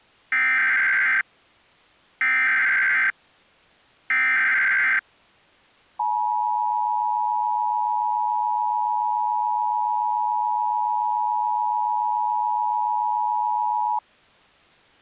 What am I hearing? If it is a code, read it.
Emergency Alert System (SAME) tones (header bursts, then the 853 and 960 Hz attention tone), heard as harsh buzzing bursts, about 520.83 baud.